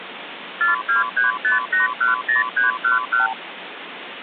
Multi-frequency trunk signalling (R2, with the far end's replies), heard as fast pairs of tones, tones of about 140 ms, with phone line noise. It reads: 4235810311